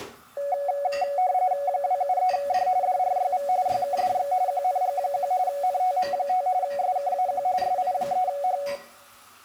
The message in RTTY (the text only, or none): 273D DRYV YKDX QNG1 NTM5 SKAQ SI3H